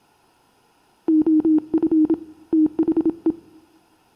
Morse code, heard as a keyed tone, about 27 wpm, 310 Hz, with room echo. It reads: OF THE